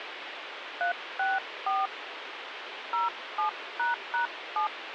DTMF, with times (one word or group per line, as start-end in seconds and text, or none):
0.8-1.9 364
2.9-4.7 07##7